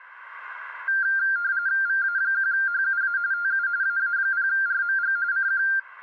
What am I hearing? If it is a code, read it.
RTTY (45.45 baud, 170 Hz shift), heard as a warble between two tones, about 1490 Hz centre. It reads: VA1HUA TU AA0RMG CQ